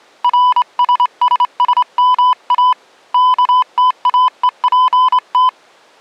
Morse code, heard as a keyed tone, hand-sent with a straight key, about 27 wpm, 1000 Hz. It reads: RSSSMA KTAEPT